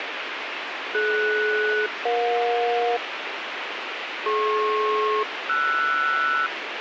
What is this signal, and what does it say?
Aircraft SELCAL, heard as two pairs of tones, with radio hiss. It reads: DS-EJ DP-RS